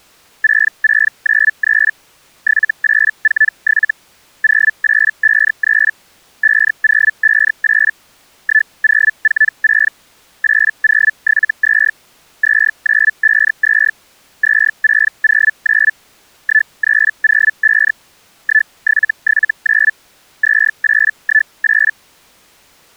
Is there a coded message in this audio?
Yes: Hellschreiber (Feld-Hell, 122.5 baud) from 0.4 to 21.9 s, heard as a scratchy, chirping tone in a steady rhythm, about 1750 Hz. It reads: 6693 7847 0853 5058 1046 8072 2952 2609 1305 1779 2818